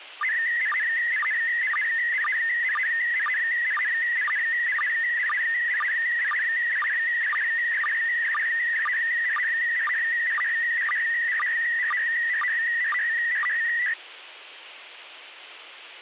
SSTV (slow-scan television), PD 120, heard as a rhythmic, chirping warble, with radio hiss.